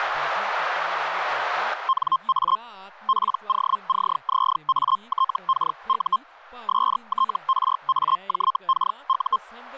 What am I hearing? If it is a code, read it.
Hellschreiber (Feld-Hell, 122.5 baud), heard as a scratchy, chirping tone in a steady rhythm, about 1060 Hz, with speech in Dogri. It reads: NA POCZATKU STRAJKU